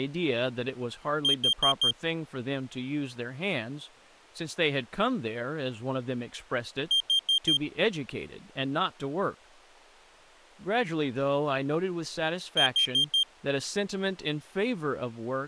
Alarm pattern, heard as an alarm's beeps, played three times, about 3200 Hz, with speech in English. Temporal four. Carbon monoxide.